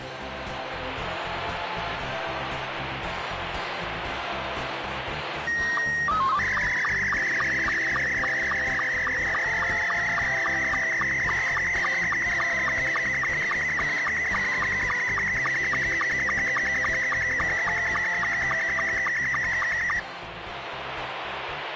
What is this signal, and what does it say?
SSTV (slow-scan television), Scottie S2, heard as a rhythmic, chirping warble, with radio static.